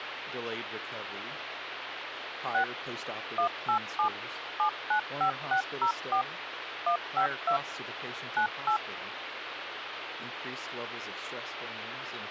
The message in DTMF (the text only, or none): 6 187 795604 152 98